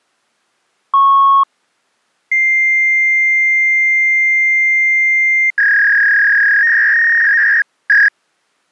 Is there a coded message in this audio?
Yes: fax machine handshake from 0.9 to 8.1 s, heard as a beep, a long tone and a warble.